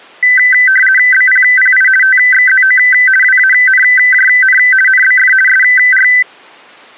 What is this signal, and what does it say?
RTTY (50 baud, 450 Hz shift), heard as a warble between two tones, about 1750 Hz centre. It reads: BPPI TXZO WANJN NBF SR